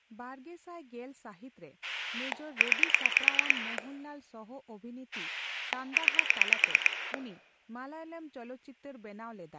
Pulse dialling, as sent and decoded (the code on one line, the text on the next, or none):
9 / 9
9 9